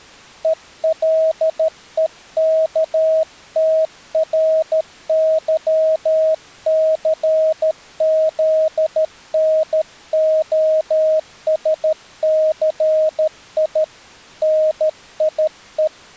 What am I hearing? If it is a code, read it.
Morse code, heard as a keyed tone, hand-sent with a paddle, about 13 wpm, 630 Hz. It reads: ELEKTRYCZNOSCI NIE